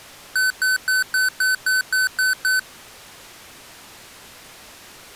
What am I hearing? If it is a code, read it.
Beep code, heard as beeps from a small speaker, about 1500 Hz. 9 short. In AMI BIOS tables: ROM checksum failure.